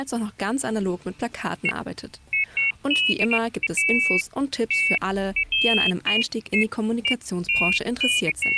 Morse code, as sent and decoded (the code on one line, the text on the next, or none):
none